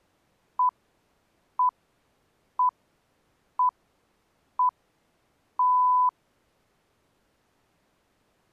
Radio time signal (six pips, as the Greenwich Time Signal), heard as pips.